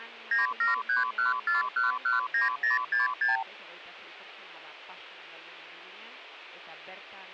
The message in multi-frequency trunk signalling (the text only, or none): 97314119066